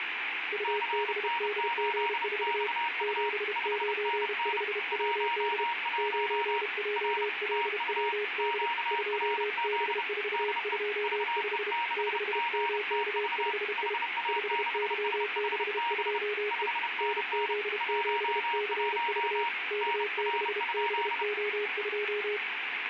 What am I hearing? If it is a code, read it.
Morse code, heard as two keyed tones, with radio static. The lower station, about 32 wpm, 420 Hz: UBDG4 795WD 9JLWD 2B425 6MK5I 5Y62E NZ7CV K6BO2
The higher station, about 30 wpm, 940 Hz: CN8XU 5NN 11 R TU QRZ DE VE6GTV HA6SHB 5NN 11 NR?